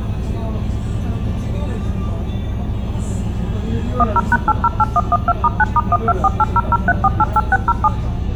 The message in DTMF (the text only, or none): 10#808112*9*1248003488607